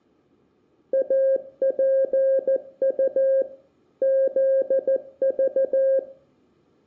Morse code, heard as a keyed tone, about 14 wpm, 540 Hz, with room echo. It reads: APU ZV